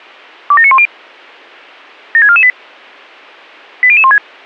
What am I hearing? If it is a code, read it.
Five-tone selective call (ZVEI), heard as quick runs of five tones, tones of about 70 ms. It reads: 27910 76448 80016